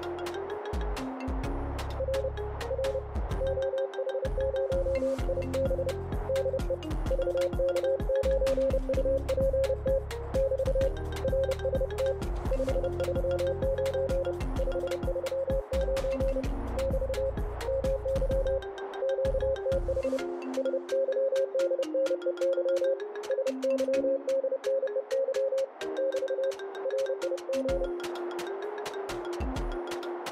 Morse code, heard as a keyed tone, hand-sent with a paddle, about 30 wpm, 540 Hz, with radio static. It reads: R R OH0IB DE VK9UPT <BT> RST 539 539 <BT> MY QTH SYDNEY SYDNEY <BT> RIG